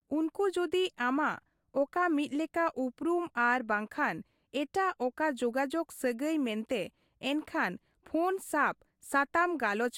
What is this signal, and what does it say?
Speech in Santali. There is no code.